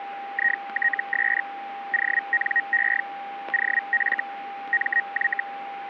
Hellschreiber (Feld-Hell, 122.5 baud), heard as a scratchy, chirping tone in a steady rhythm, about 1900 Hz, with a steady whistle near 800 Hz. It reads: ITS ONE OF MY